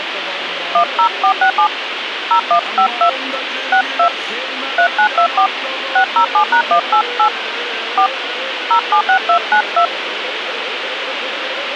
DTMF, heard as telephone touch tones, dialled by hand, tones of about 90 ms, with radio hiss. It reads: 10467 0152 62 3924 607#188 4 076292